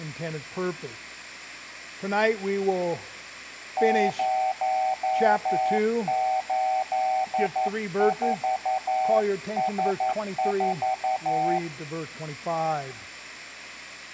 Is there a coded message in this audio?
Yes: Morse code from 3.7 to 11.6 s, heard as a keyed tone, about 11 wpm, 760 Hz, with room echo. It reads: 084S4